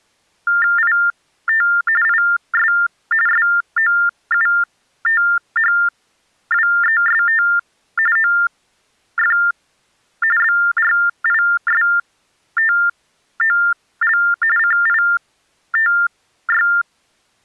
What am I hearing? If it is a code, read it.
TTY/TDD text telephone tones (45.45 baud Baudot), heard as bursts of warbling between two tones, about 400 Hz shift, 1600 Hz centre. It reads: IT IS SOUTHWEST OF BRISTOL CITY